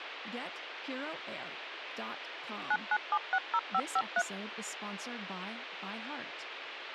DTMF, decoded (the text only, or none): 99760553